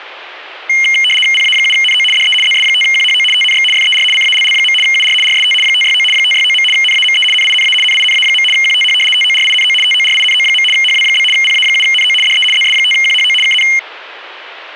RTTY (75 baud, 850 Hz shift), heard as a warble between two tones, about 2550 Hz centre. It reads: PA7NO DE ZS5QHO TNX FER CALL. UR RST 569 569. NAME NINA NINA. QTH TORINO TORINO. HW? PA7NO DE ZS5QHO KN